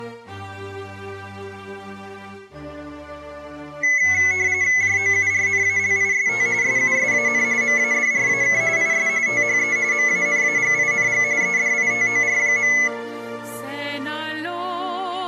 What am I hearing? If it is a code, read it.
RTTY (45.45 baud, 170 Hz shift), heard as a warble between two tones, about 2100 Hz centre. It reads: JOURNALIST SUSAN MADRAK IS THE MANAGING EDITOR.